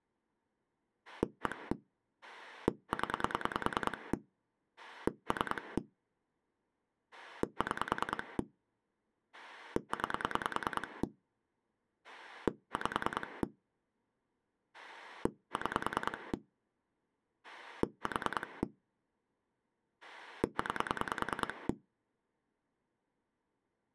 Pulse dialling, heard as a rotary dial, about 10 pulses a second. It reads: 1 0 3 6 9 5 6 4 9